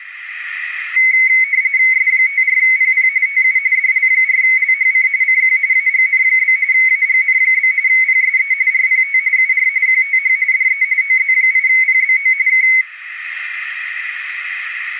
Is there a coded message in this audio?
Yes: RTTY (45.45 baud, 170 Hz shift) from 1.0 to 12.8 s, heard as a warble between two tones, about 2150 Hz centre. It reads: S54PP TU DL4LHC CQ AGN? AGN? PSE RPT UR QTH DE OZ8PBO K